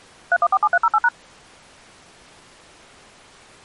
DTMF, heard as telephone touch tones, dialled by machine, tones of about 50 ms. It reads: 3147308#